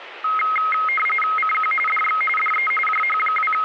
RTTY (45.45 baud, 850 Hz shift), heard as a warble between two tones, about 1700 Hz centre, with radio static. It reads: CQ DX DE …